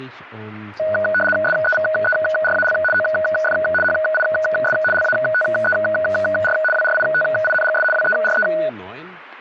RTTY (75 baud, 850 Hz shift), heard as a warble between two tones, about 1050 Hz centre, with speech in German. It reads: SEVERAL OF HIS LATER WRITINGS WERE